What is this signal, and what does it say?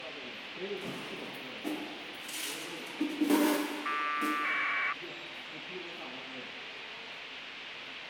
Packet radio (AX.25, as in APRS), 1200 baud, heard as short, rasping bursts, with radio hiss and the noise of a subway station.